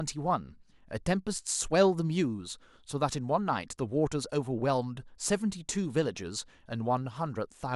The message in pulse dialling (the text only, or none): none